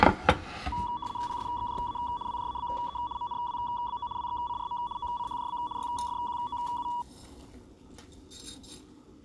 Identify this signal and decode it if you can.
RTTY (75 baud, 170 Hz shift), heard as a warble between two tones, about 1050 Hz centre, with kitchen noise. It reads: PSXJA WJABE MNWBO WXCRM OCHJB YFQOU